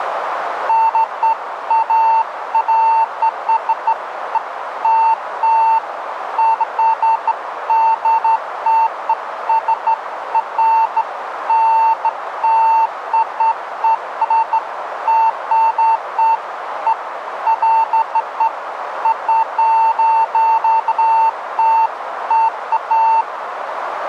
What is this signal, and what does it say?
Beeps of irregular length, with radio static and a narrow filter. There is no code.